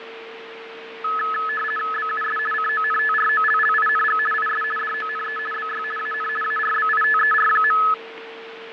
RTTY (50 baud, 450 Hz shift), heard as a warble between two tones, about 1500 Hz centre, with radio static, fading and a steady whistle near 450 Hz. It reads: BUS CONTROLLING IS DONE BY AN ARBITER.